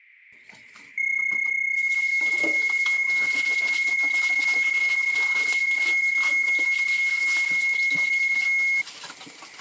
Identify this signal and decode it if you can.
PSK31 (31.25 baud), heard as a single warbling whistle, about 2150 Hz, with static crashes and kitchen noise.